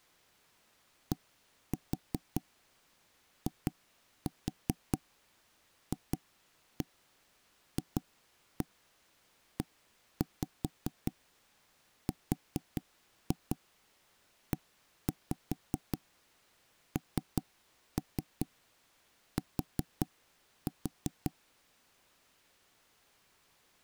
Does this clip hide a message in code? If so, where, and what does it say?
Yes: tap code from 1.1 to 21.3 s, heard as knocks on wood, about 5 knocks a second. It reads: DIFFERENT